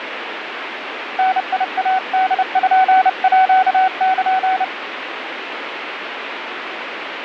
Morse code (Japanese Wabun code), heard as a keyed tone, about 30 wpm, 750 Hz, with radio static. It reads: ダイポール